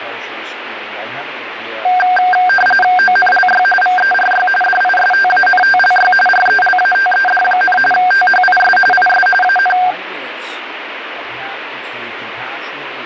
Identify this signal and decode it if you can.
RTTY (45.45 baud, 850 Hz shift), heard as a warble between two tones, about 1160 Hz centre, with radio static. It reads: ONLY VERY DISTANTLY RELATED, THIS IS AN